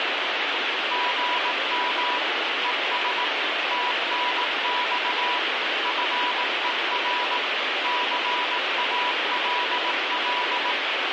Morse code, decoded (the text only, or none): GM ES TNX FER CALL